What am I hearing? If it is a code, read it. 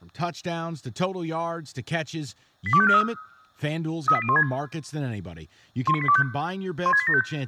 Five-tone selective call (ZVEI), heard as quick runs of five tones, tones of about 70 ms, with speech in English. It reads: 82543 38016 19825 16875